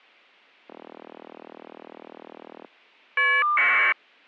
Caller ID data burst, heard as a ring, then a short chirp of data, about 1200 baud.